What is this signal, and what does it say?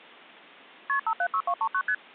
Multi-frequency trunk signalling (R1, as on North American trunks), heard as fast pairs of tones, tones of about 70 ms. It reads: KP 576239 ST